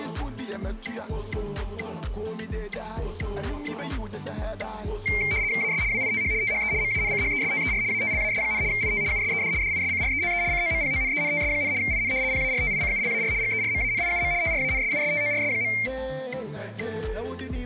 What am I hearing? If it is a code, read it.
RTTY (75 baud, 170 Hz shift), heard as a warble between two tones, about 2200 Hz centre. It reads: AS WITH THE MANCHESTER ATLAS, IT USED DISCRETE COMPONENTS, IN PARTICULAR GERMANIUM TRANSISTORS.